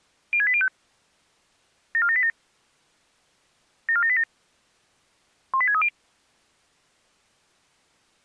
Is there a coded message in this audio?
Yes: five-tone selective call (ZVEI) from 0.3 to 5.9 s, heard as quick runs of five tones, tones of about 70 ms. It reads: 06805 74787 74787 18630